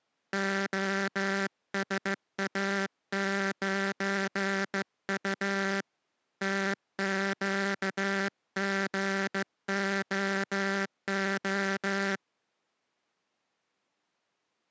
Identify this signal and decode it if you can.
Morse code, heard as a buzzer, hand-sent with a straight key, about 15 wpm. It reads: OSA9U TQGOO